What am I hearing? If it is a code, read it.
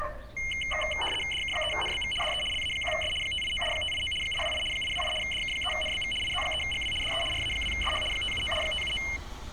RTTY (75 baud, 850 Hz shift), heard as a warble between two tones, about 2550 Hz centre, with street noise. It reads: DK3NBV DE LA1S 589 589 828 828 DK3NBV IZ3GW DE RA2SH 579 579